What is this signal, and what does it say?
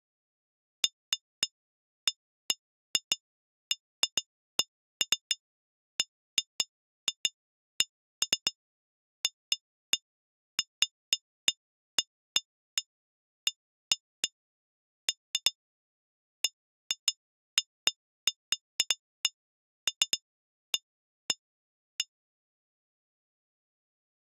Irregular taps on glass. There is no code.